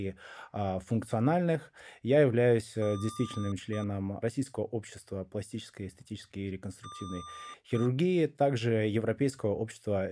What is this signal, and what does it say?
Beep code, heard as beeps from a small speaker, played twice, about 1200 Hz, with speech in Russian. 1 long, 1 short. In IBM BIOS tables: system board problem.